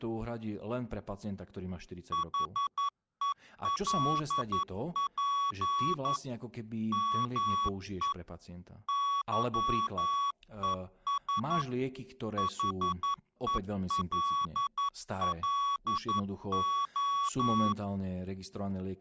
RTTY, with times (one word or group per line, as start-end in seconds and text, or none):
none